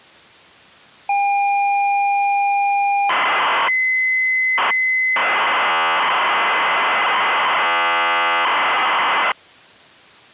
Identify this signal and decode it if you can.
ZX Spectrum tape loading, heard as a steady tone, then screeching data.